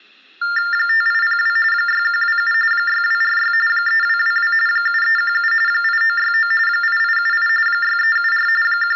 TTY/TDD text telephone tones (45.45 baud Baudot), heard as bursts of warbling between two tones, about 400 Hz shift, 1600 Hz centre, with room echo. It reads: 5802 6127 6246 3222 7317 8969 8878 6374 …